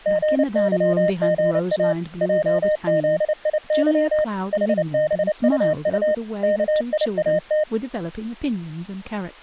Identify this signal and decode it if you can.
Morse code, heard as a keyed tone, machine-sent, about 29 wpm, 610 Hz, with speech in English. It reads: GYGA JZIY HBUU KIAT